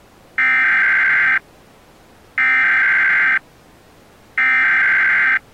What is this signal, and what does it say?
Emergency Alert System (SAME) tones (header bursts), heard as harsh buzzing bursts, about 520.83 baud.